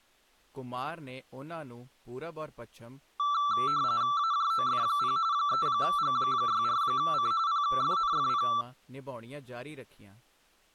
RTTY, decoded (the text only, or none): AJOF0 3G64C PFNFP